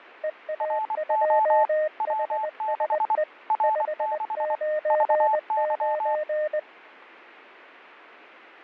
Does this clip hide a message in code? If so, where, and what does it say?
Yes: Morse code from 0.2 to 6.7 s, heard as two keyed tones. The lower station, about 20 wpm, 610 Hz: EA2HSE 599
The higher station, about 24 wpm, 870 Hz: RO W6 R6 VY